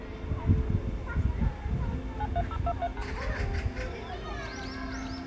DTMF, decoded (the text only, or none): 93023#